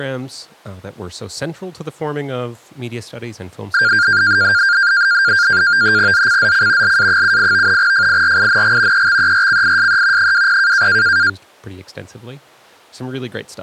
NAVTEX (SITOR-B), 100 baud, 170 Hz shift, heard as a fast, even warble, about 1500 Hz centre, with speech in English. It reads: ZCZC LA78 FIRING EXERCISE 20